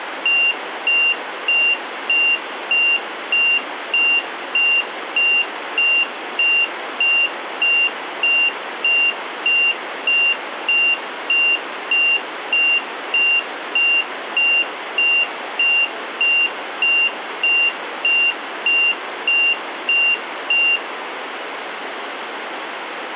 Evenly repeated beeps, with room echo. There is no code.